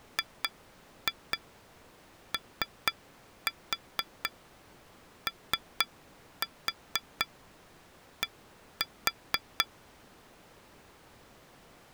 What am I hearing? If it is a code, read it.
Tap code, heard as taps on glass, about 4 knocks a second. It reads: GOOD